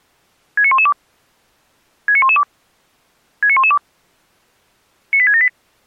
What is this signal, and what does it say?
Five-tone selective call (ZVEI), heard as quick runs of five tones, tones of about 70 ms. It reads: 69112 69112 69112 98678